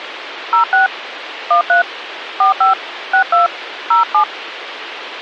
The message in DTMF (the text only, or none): 06 13 45 62 07